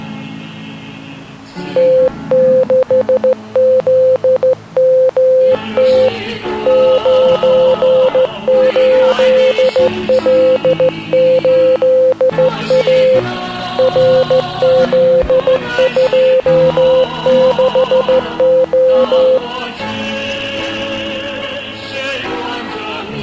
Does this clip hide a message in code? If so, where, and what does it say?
Yes: Morse code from 1.7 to 19.4 s, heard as a keyed tone, hand-sent with a straight key, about 14 wpm, 520 Hz. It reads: T6ZMT 98L8A RZ26O